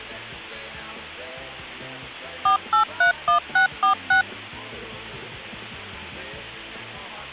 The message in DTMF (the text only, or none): 4831646